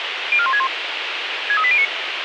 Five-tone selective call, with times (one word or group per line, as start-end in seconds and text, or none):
0.3-0.7 04161
1.5-1.8 63809